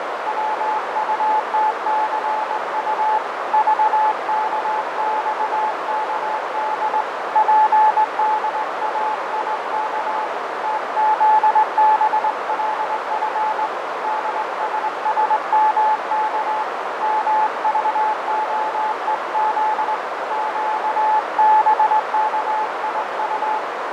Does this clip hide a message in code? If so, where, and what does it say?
Yes: Morse code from 0.2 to 23.6 s, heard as a keyed tone, hand-sent with a straight key, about 20 wpm, 860 Hz, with heavy radio static, fading and a narrow filter. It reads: WUTCU VKXKD PDAIK TZBLF DSSMK MVOEZ QBKIU